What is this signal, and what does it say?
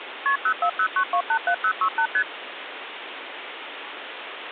Multi-frequency trunk signalling (R1, as on North American trunks), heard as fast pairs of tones, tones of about 80 ms, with phone line noise. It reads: KP 0409287068 ST